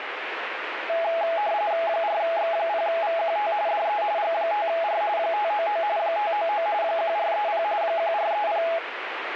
RTTY (45.45 baud, 170 Hz shift), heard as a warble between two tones, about 750 Hz centre, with radio static. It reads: 4X0VQT DE G5R 599 599 1430 1430